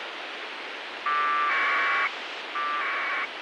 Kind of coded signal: packet radio (AX.25, as in APRS)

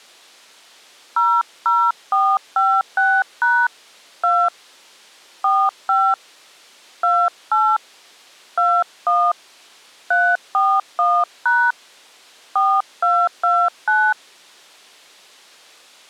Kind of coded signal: DTMF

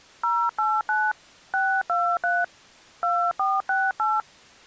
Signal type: DTMF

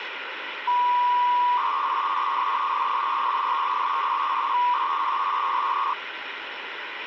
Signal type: 300-baud modem data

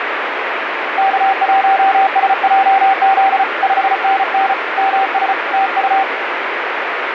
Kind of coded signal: Morse code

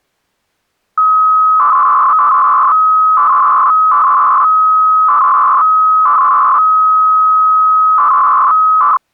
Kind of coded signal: 300-baud modem data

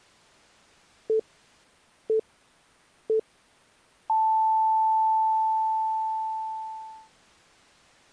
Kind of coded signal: radio time signal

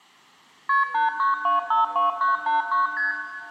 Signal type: multi-frequency trunk signalling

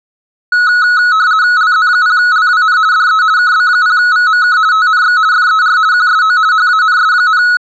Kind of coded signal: RTTY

